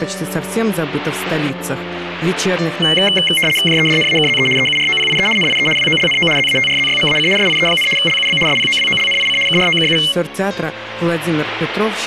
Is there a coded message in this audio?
Yes: RTTY (75 baud, 850 Hz shift) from 2.8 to 10.1 s, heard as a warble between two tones, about 2550 Hz centre, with static crashes. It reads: JEDNAKZE EUROPIE NIE WOLNO ZATRZYMAC SIE, LUB SPOWOLNIC KROKU